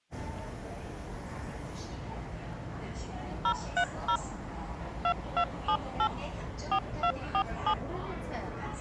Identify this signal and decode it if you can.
DTMF, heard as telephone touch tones, dialled by machine, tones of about 80 ms, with the noise of a subway station. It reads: 030 2278 4247